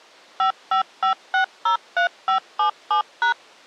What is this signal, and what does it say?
DTMF, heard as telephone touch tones, dialled by machine, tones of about 110 ms. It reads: 555603577#